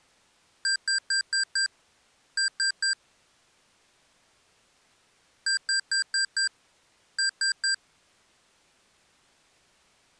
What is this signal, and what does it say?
Beep code, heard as beeps from a small speaker, played twice, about 1600 Hz. 5-3.